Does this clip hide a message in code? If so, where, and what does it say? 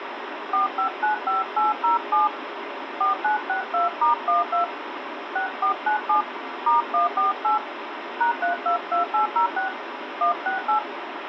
Yes: DTMF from 0.5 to 10.8 s, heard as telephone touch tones, dialled by hand, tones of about 130 ms, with phone line noise. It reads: 4595807 4962*12 6497 *148 #322806 168